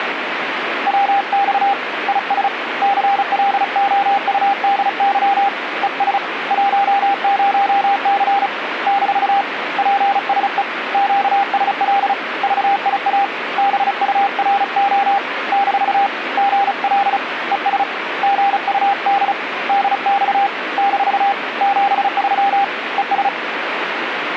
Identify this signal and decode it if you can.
Morse code, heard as a keyed tone, hand-sent with a paddle, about 35 wpm, 800 Hz, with radio static. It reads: WX IS CLOUDY ES 10C - PSE QSL VIA BURO - GL ES GUD DX - 73 ES